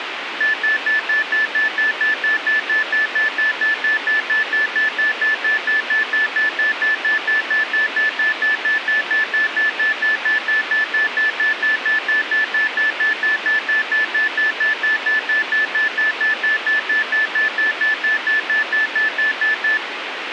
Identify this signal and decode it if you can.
Evenly repeated beeps, with radio hiss and a squelch burst at the end. There is no code.